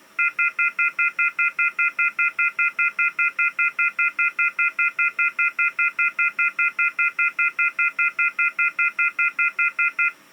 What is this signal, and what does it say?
Telephone call progress tone (North American plan), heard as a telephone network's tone, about 1400, 2050, 2450, 2600 Hz, 0.1 s on and 0.1 s off. Off-hook warning tone.